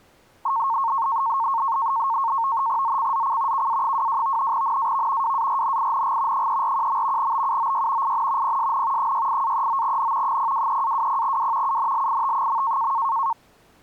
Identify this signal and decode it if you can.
NAVTEX (SITOR-B), 100 baud, 170 Hz shift, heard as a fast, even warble, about 1000 Hz centre. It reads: ZCZC KA22 NAV WARNING 341. BUOY IN PSN 68-39N 023-20W UNLIT.